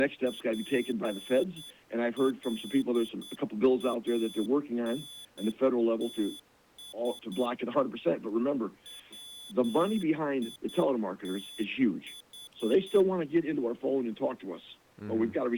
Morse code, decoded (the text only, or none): PLANTS WITH